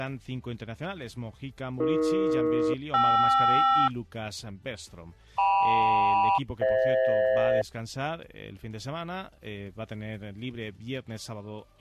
Aircraft SELCAL, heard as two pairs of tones. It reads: AE-KR KM-FH